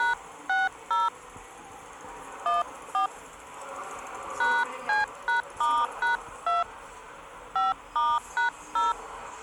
DTMF, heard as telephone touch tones, dialled by hand, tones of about 180 ms, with the noise of a subway station. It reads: #60 14 #C#*#2 5*#0